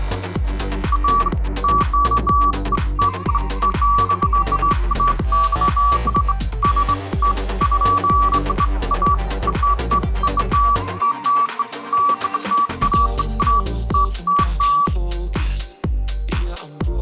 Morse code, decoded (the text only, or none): none